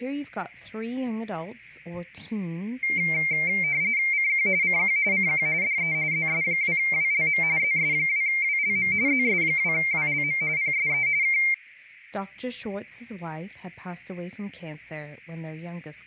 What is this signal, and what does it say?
RTTY (45.45 baud, 170 Hz shift), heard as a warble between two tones, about 2200 Hz centre, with speech in English. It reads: CQ CQ CQ DE ZS2WLM ZS2WLM ZS2WLM PSE K